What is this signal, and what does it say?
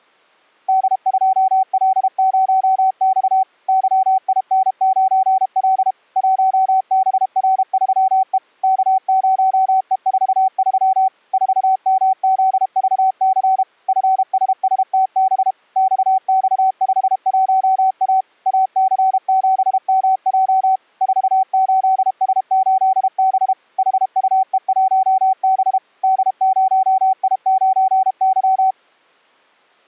Morse code, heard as a keyed tone, machine-sent, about 32 wpm, 760 Hz. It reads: D2L0X YIN9L 1BR3E K0E43 4MZVC FSSTB XX51A AC7MJ 48S8B HUE1B D0I9Y